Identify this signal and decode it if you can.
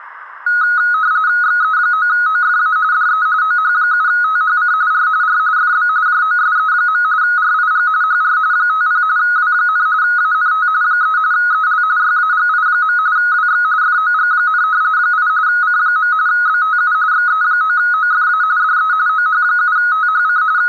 RTTY (45.45 baud, 170 Hz shift), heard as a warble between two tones, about 1360 Hz centre. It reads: XE9OFA DE OH7THC R R FB JOSE. RIG HR 50 W, ANT 3 EL YAGI. WX FOG, 8 C. BTU XE9OFA DE OH7THC …